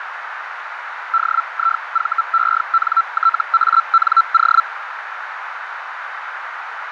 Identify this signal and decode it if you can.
Hellschreiber (Feld-Hell, 122.5 baud), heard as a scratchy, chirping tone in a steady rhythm, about 1340 Hz, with radio static and a narrow filter. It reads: DIVENTANO